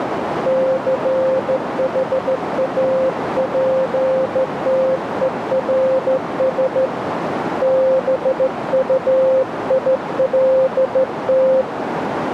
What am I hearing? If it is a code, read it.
Morse code, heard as a keyed tone, hand-sent with a straight key, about 14 wpm, 520 Hz, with radio static and a narrow filter. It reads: CHAPTERS BUILT